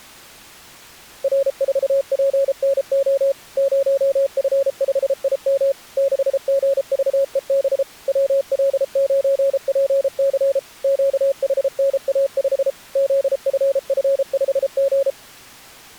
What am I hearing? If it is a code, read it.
Morse code, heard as a keyed tone, machine-sent, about 33 wpm, 550 Hz. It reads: R4PNO 0F5IM 6GVEB WL9PC QHNA5 ZFF5G